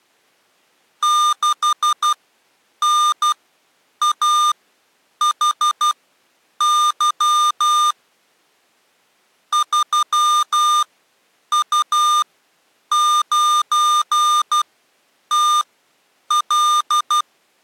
Morse code, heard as electronic beeps, machine-sent, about 12 wpm, spaced as for 8 wpm, 1210 Hz. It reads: 6NAHY 3U9TL